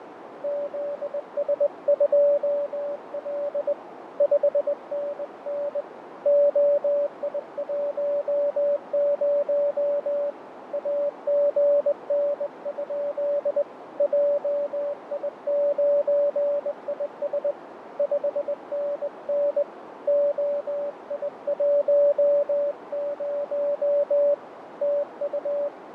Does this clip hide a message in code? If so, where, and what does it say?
Yes: Morse code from 0.4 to 25.7 s, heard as a keyed tone, hand-sent with a straight key, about 20 wpm, 580 Hz, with radio static, fading and a narrow filter. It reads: ZS2L 5NN OI10 AGN? JI9IS 5NN OI10 TU